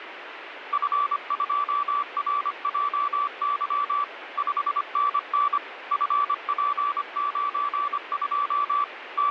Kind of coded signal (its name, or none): Morse code